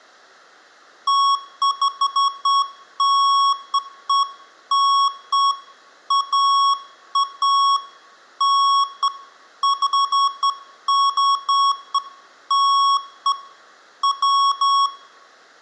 Beeps of irregular length, with room echo. There is no code.